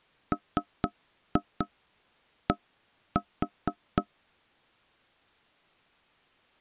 Tap code, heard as knocks on wood, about 4 knocks a second. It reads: MD